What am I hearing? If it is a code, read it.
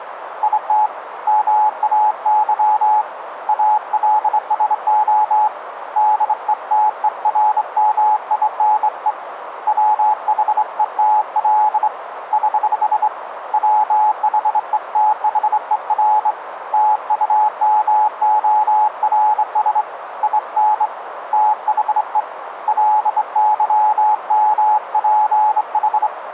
Morse code, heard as a keyed tone, hand-sent with a straight key, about 25 wpm, 850 Hz, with radio static and a narrow filter. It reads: IT MAY ALSO DETERMINE WHETL <HH> WHETHER TUMORS IN THE LYMPH